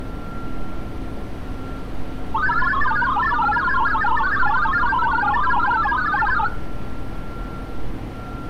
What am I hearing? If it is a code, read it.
Multi-tone FSK (Olivia or MFSK type), about 1000 Hz wide, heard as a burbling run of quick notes, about 62.5 baud, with room echo and street noise.